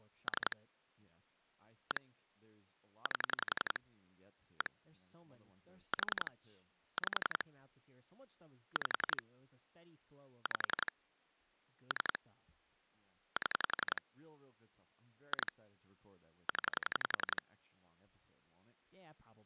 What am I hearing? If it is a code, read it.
Pulse dialling, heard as clicks on a phone line, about 11 pulses a second, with speech in English. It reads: 3 1 8 1 4 5 5 5 3 7 2 0